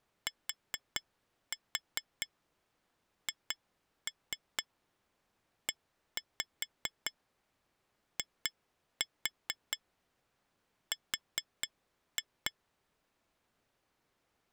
Tap code, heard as taps on glass, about 4 knocks a second. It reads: THEIR